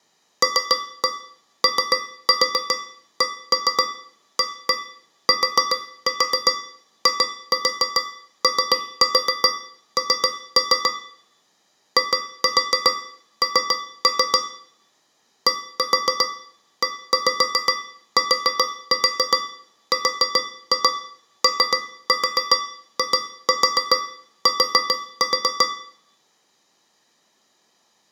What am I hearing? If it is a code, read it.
Tap code, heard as taps on a metal pipe, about 7 knocks a second, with room echo. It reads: LOCATION IN DETROIT